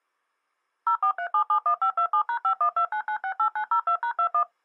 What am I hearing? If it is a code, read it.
DTMF, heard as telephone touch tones, dialled by machine, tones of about 90 ms. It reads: 043771527#5129968902#21